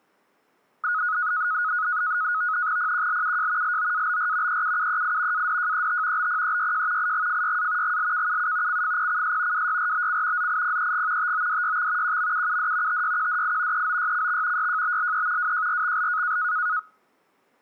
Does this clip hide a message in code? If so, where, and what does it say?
Yes: NAVTEX (SITOR-B), 100 baud, 170 Hz shift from 0.8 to 16.8 s, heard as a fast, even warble, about 1360 Hz centre. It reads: PQLUJ LOABR EUUEI ADJET BPEYJ IGFYA GLKUU CFPCS WYRBC ZIPEG TODYX QMUUD TYQDI EOYCX YJBLE WJRXL